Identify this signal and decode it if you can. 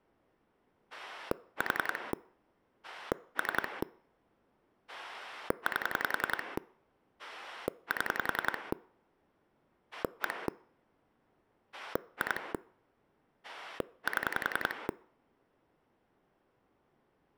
Pulse dialling, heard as a rotary dial, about 10 pulses a second. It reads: 4 3 8 7 1 2 7